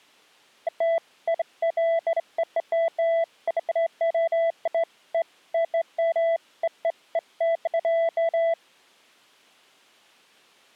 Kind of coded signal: none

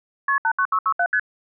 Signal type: multi-frequency trunk signalling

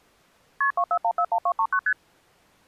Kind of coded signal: multi-frequency trunk signalling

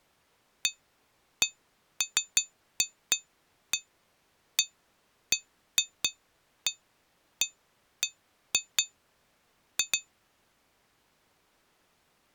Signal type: none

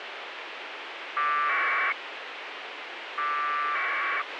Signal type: packet radio (AX.25, as in APRS)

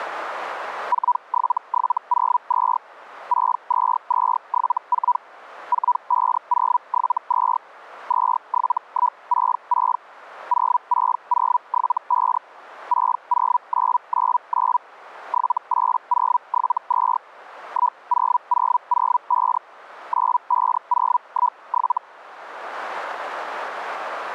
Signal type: Hellschreiber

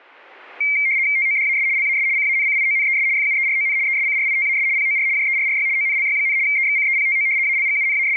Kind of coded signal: RTTY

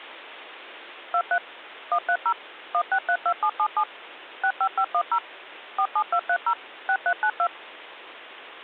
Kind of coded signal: DTMF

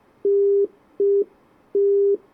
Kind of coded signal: telephone call progress tone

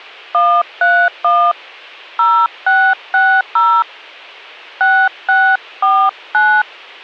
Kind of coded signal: DTMF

